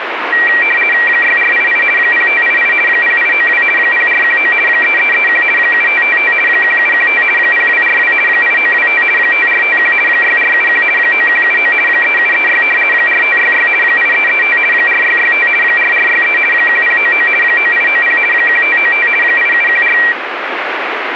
RTTY (50 baud, 450 Hz shift), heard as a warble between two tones, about 2100 Hz centre, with radio static. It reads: 6488 0588 0892 0419 3331 7555 1715 0242 8925 5451 6471 9179 3736 4566 8335 4665 4463 1099 9890 1595 8714